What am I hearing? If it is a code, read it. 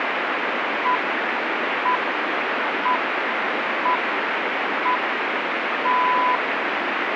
Radio time signal (six pips, as the Greenwich Time Signal), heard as pips, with radio static.